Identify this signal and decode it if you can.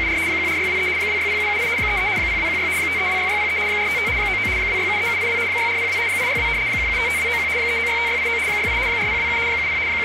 RTTY (75 baud, 170 Hz shift), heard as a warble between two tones, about 2200 Hz centre, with radio static. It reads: … 14623 260778 33 0216 5326603 455 99 2673782 6402 862 1755291 3965689 68 4027 70 …